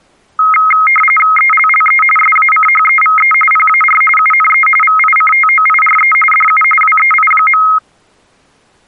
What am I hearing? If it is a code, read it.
RTTY (45.45 baud, 850 Hz shift), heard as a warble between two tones, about 1700 Hz centre. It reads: ELLE SACHEVE PAR UNE VICTOIRE DU WEI.